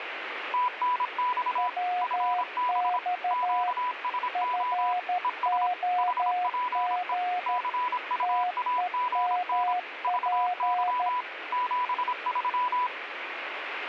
Morse code, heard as two keyed tones, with radio static. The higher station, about 26 wpm, 990 Hz: TNX FB QSO ES HPE CUAGN VY 73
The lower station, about 13 wpm, 720 Hz: WX FOG TEMP